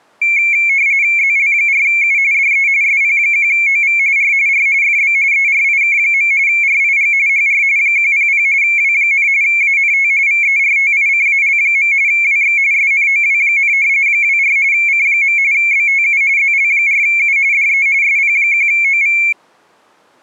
RTTY (45.45 baud, 170 Hz shift), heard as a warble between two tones, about 2250 Hz centre. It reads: ZL4U DE SP1OV R R FB ERIK. RIG HR 100 W, ANT VERTICAL. WX SNOW, 24 C. BTU ZL4U DE SP1OV